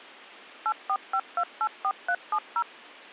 DTMF, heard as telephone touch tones, dialled by machine, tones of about 60 ms. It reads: 845284370